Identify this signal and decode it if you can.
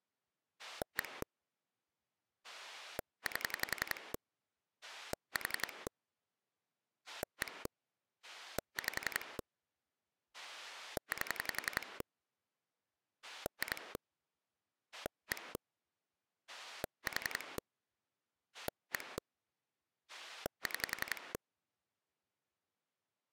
Pulse dialling, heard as a rotary dial, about 11 pulses a second. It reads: 1 8 4 1 5 8 2 1 4 1 6